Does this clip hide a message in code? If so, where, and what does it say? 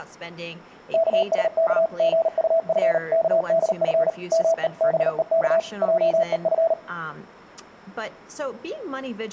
Yes: Morse code (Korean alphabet) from 0.9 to 6.8 s, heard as a keyed tone, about 38 wpm, 660 Hz, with speech in English. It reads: 영신은 마당 한